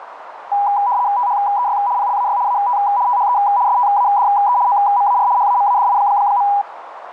RTTY (75 baud, 170 Hz shift), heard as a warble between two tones, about 900 Hz centre, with radio static and a narrow filter. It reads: THEY PLAY AT THE STADE OMAR HAMADI.